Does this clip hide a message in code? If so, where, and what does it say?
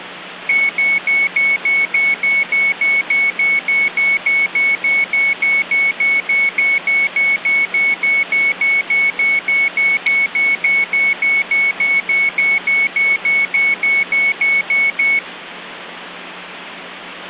No, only evenly repeated beeps.